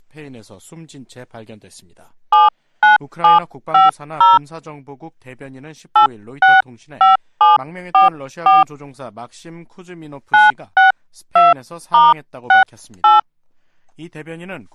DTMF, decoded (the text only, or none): 79750 865744 962*68